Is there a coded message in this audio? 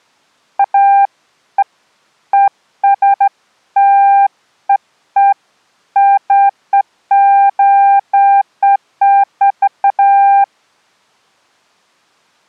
No, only beeps of irregular length.